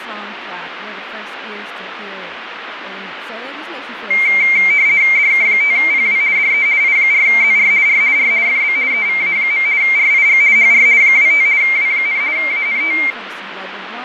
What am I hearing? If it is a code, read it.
RTTY (50 baud, 170 Hz shift), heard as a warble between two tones, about 2200 Hz centre, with radio static, fading and speech in English. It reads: DK5PW DE I4ZR R R FB EVA. RIG HR 25 W, ANT